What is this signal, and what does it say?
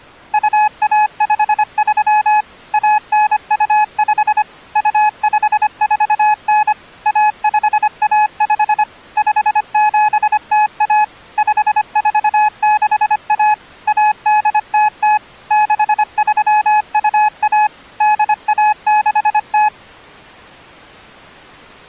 Morse code (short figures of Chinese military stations), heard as a keyed tone, machine-sent, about 25 wpm, 850 Hz. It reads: 2153 1925 2549 1515 5701 5461 1800 6321 8160